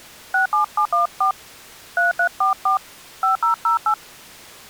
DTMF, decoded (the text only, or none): 67714 3344 5008